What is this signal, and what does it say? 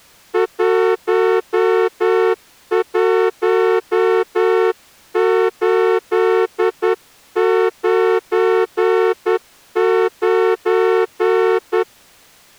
Morse code, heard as a horn, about 10 wpm. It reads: 11899